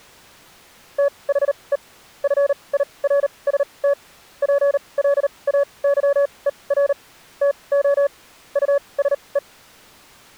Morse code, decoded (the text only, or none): THE FIRST PLAYER TO USE